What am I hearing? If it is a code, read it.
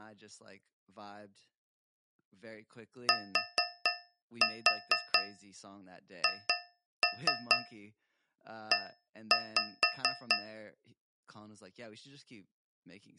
Tap code, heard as taps on a metal pipe, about 4 knocks a second, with speech in English. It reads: THE